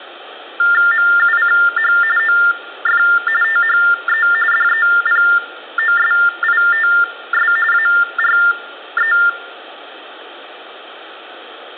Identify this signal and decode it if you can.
TTY/TDD text telephone tones (45.45 baud Baudot), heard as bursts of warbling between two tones, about 400 Hz shift, 1600 Hz centre, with room echo. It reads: MUCH OF THE DEPOSITS ARE